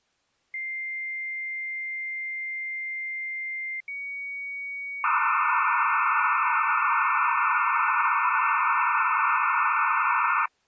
Dial-up modem handshake (low-speed, two carriers), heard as two whistles, then hiss.